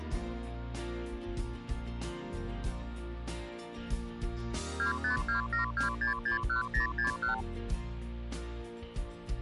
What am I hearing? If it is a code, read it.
Multi-frequency trunk signalling (R2, with the far end's replies), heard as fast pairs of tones, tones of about 120 ms. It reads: 25272661061